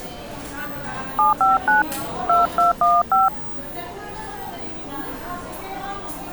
DTMF, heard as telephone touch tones, dialled by hand, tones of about 160 ms, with the noise of a cafe. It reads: 759 2215